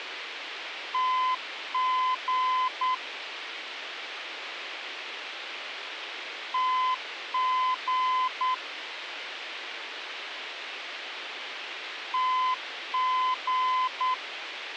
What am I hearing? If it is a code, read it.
Morse code, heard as a keyed tone, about 9 wpm, 1020 Hz, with radio hiss. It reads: TG TG TG